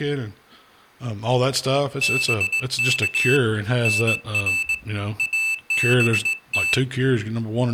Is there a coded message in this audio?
Yes: Morse code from 2.0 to 6.8 s, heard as a high beeper, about 19 wpm, 2650 Hz, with speech in English. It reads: BK NR ABT